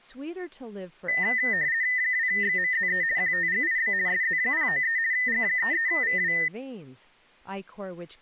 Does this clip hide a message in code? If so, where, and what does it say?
Yes: RTTY (50 baud, 170 Hz shift) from 1.1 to 6.5 s, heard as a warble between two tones, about 1900 Hz centre, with speech in English. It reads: 2XMZE QTGIB SZ093 G33VW